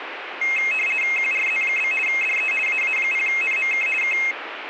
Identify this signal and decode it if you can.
RTTY (50 baud, 450 Hz shift), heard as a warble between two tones, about 2350 Hz centre, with radio static. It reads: QRZ? DE AA0NMK K